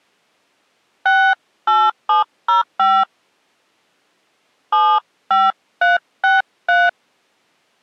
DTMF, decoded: 68705 75363

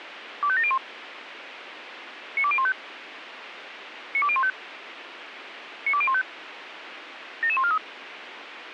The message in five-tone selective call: 25701 92015 92015 92015 77143

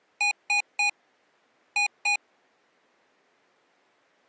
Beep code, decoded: 3-2

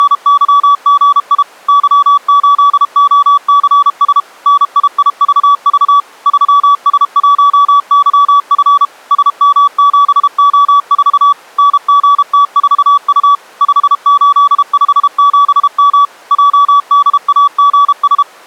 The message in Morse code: … Y8OCS NIIVV 3S1YF SM7O4 NGT4U 5857M JDAGS

